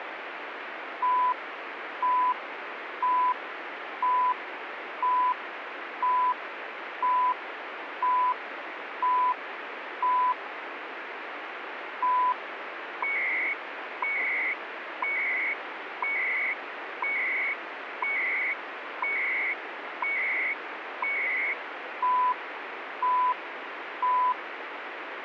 Radio time signal (CHU, Canada), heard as beeps and data bursts, one a second, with radio static.